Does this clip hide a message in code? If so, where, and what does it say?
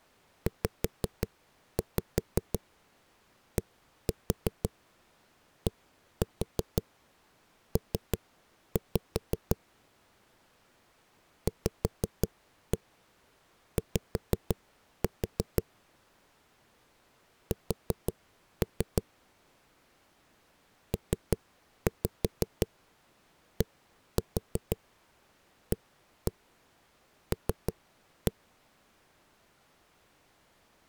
Yes: tap code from 0.5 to 28.3 s, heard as knocks on a wall, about 5 knocks a second. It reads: ZDDP VY S PDAL